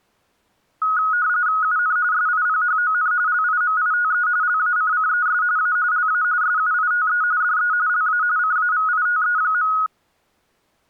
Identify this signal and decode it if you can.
RTTY (45.45 baud, 170 Hz shift), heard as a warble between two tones, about 1360 Hz centre. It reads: UN SIPHON LIMITE LACCES A LA SUITE DE LA CAVITE.